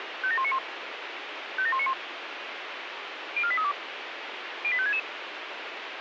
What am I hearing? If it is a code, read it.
Five-tone selective call (ZVEI), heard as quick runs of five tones, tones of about 70 ms, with radio hiss. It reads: 57191 57191 04832 08566